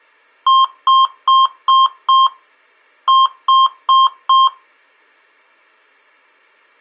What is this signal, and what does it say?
Beep code, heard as beeps from a small speaker, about 1060 Hz. 5-4.